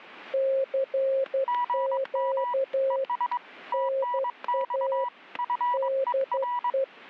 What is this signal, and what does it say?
Morse code, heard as two keyed tones, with static crashes. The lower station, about 12 wpm, 540 Hz: CQ NA DE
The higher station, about 22 wpm, 980 Hz: GM ES TNX FER